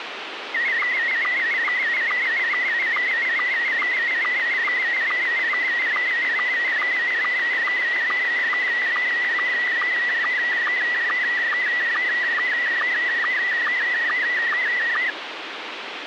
SSTV (slow-scan television), Scottie S1, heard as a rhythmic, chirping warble, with radio hiss.